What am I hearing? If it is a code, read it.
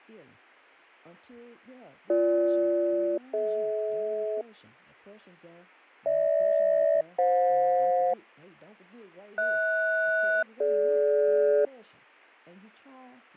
Aircraft SELCAL, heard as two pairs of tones, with fading and speech in English. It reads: BG-DH GH-FJ HS-DG